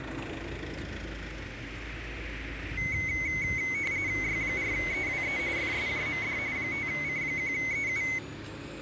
RTTY (45.45 baud, 170 Hz shift), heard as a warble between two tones, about 2150 Hz centre, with radio static and the noise of a residential street. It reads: Y4EWE FSJMD 5C1EU